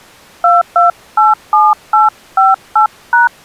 DTMF, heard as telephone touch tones, dialled by hand, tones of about 160 ms. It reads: 2287858#